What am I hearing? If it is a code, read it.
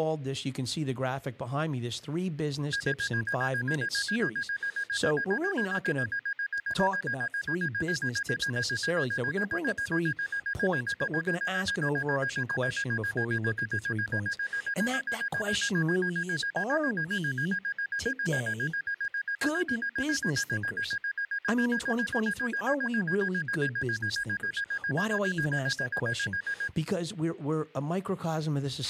Evenly repeated beeps, with a squelch burst at the end and speech in English. There is no code.